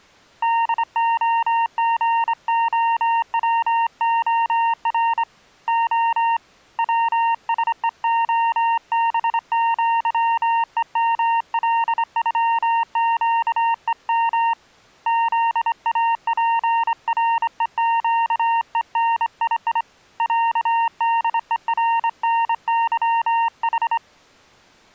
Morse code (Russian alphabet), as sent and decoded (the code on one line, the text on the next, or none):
-.. --- --. --- .-- --- .-. / --- / .-- ... . --- -... --.-- . -- .-.. ..-- --.- . -- / --.. .- .--. .-. . --.- . -. .. .. / .-.- -.. . .-. -. -.-- ....
ДОГОВОР О ВСЕОБЪЕМЛЮЩЕМ ЗАПРЕЩЕНИИ ЯДЕРНЫХ